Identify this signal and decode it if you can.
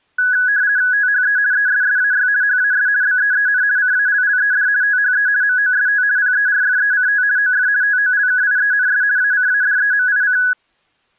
RTTY (50 baud, 170 Hz shift), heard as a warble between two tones, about 1600 Hz centre. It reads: THE ESSAY HAS BEEN CALLED THE MOST PERFECT OF TOLKIENS ACADEMIC